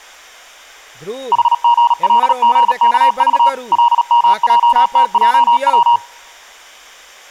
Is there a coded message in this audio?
Yes: Morse code (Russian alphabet) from 1.3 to 6.0 s, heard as a keyed tone, machine-sent, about 37 wpm, 950 Hz, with speech in Maithili. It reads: ХГЛГКЖ ЛМЙТЙВ